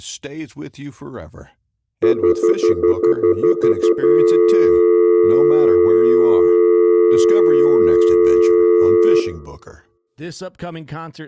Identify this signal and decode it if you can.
Telephone call progress tone (North American plan), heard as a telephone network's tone, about 350, 440 Hz, 0.1 s on and 0.1 s off, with room echo and speech in English. Stutter dial tone.